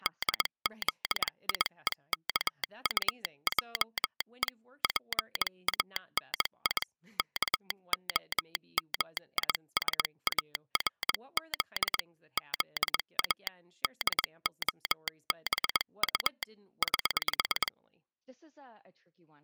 Morse code, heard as a telegraph sounder, hand-sent with a paddle, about 21 wpm, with speech in English. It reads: DZIEKUJE PANI KOMISARZ ZA DOBU <HH>